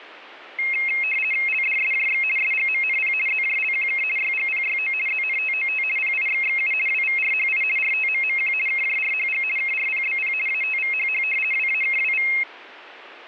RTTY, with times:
1.5-2.2 LDSJX
2.4-3.1 SGMNP
3.3-4.0 ZJLQK
4.2-4.9 YGPYO
5.1-5.8 ZNTOT
6.0-6.7 PIXXU
6.9-7.6 WVRHI
7.8-8.5 RTMMQ
8.7-9.4 KJRHG
9.6-10.3 KRPBP
10.5-11.2 ATVHH
11.5-12.3 WAKWV

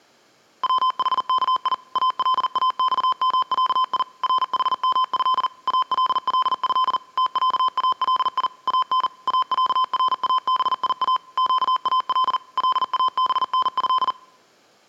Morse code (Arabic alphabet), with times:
0.6-1.7 وحكي
2.0-4.0 الاصمعي
4.2-5.5 رحمه
5.7-7.0 الله
7.2-8.5 تعالي
8.7-9.1 ان
9.3-11.2 اعرابيا
11.4-12.4 قال
12.6-14.1 لابنه

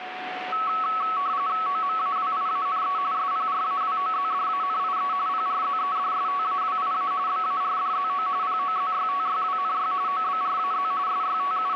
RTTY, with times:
1.7-3.0 OMAWIANE
3.1-5.1 SPRAWOZDANIE
5.3-7.1 PRZEDSTAWIA
7.3-8.3 BARDZO
8.4-9.9 POZYTYWNY
10.1-10.9 OBRAZ
11.1-11.8 …

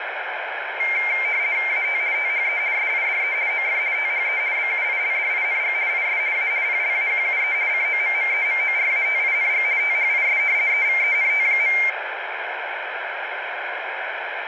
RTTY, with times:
1.7-2.0 AT
2.1-2.6 THE
2.7-3.3 SIDE
3.5-3.8 OF
3.9-4.4 THE
4.5-5.7 BUILDING
5.9-6.2 IS
6.3-6.5 A
6.6-7.5 PLAQUE
7.7-9.6 COMMEMORATING
9.8-10.4 THIS
10.7-11.7 EVENT.

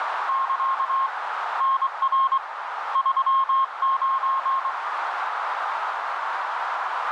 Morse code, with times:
0.3-1.1 <KA>
1.6-2.4 NR
3.0-4.7 39

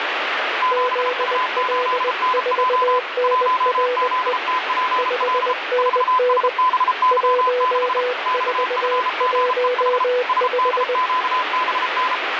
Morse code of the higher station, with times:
0.6-3.0 7U8NJ
3.2-5.5 1ZTPL
5.8-8.0 4SBY6
8.3-10.0 XFGEH
10.3-12.1 SDQBN

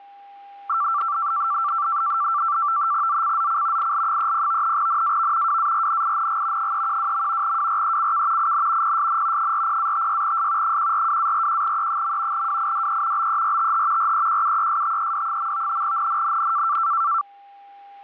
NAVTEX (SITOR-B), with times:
3.1-3.9 ZCZC
3.8-4.8 IL30
4.8-5.6 NAV
5.5-6.7 WARNING
6.6-7.6 312.
7.4-8.5 WRECK
8.4-9.0 IN
8.8-9.5 PSN
9.4-10.8 40-56S
10.6-12.5 142-41E.
12.3-13.3 WIDE
13.2-14.1 BERTH
14.0-15.8 REQUESTED.
15.8-16.8 NNNN

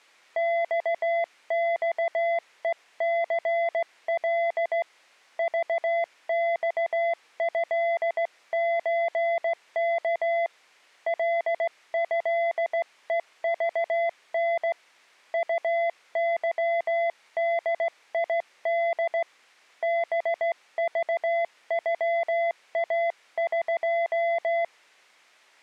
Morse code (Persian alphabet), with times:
0.4-4.8 خخهثل
5.4-10.5 ذخضچک
11.1-14.7 لضهذن
15.3-19.2 طظدید
19.8-24.6 بذغاق

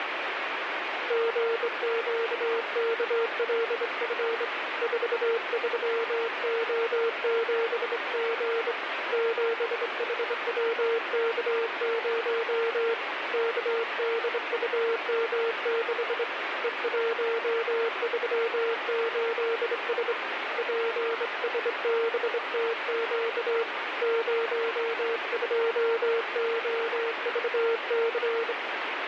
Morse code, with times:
1.1-4.4 GQKLF
4.8-8.7 43O7G
9.1-12.9 7HWK0
13.3-16.2 KDUM6
16.6-20.1 E138S
20.6-23.6 PSBTQ
24.0-28.5 02OVC

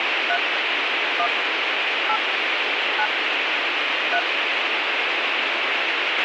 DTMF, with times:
0.3-0.4 3
1.2-1.3 1
2.1-2.2 8
3.0-3.1 9
4.1-4.2 3

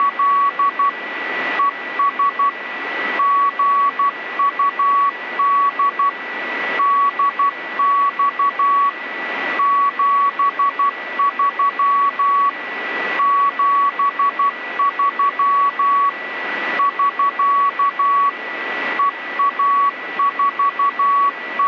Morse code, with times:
0.0-0.9 …
1.6-2.5 ES
3.2-6.1 GUD
6.8-8.9 DX
9.6-12.5 73
13.2-16.1 73
16.8-18.3 <SK>
19.0-21.7 …

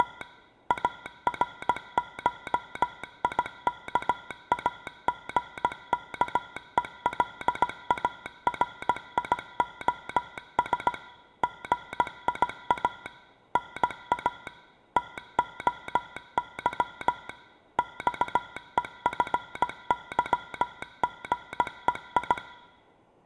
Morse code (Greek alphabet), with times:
0.0-0.2 …
0.7-10.9 ΑΡΧΙΚΑΓΚΕΛΑΡΙΟΣ
11.4-13.1 ΓΙΑ
13.6-14.5 ΝΑ
15.0-17.3 ΤΟΥ
17.8-22.4 ΞΕΦΥΓΕΙ

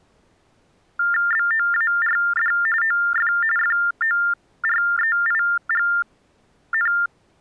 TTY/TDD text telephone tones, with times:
1.3-2.5 BOARD
2.8-3.3 OF
3.6-6.9 FOREIGN

